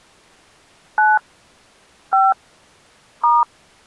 DTMF, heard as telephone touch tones, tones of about 200 ms. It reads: 9 5 *